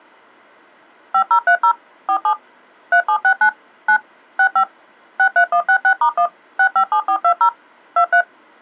DTMF, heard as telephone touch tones, dialled by machine, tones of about 80 ms. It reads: 5030 47 3769 9 65 63166*1 657420 23